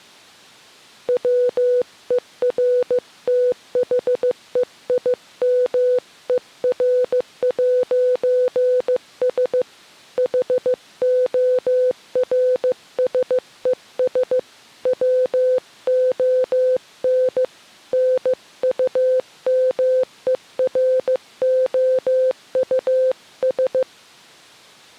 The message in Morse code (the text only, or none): WERTHEIMER'S HORSES WON NUMEROUS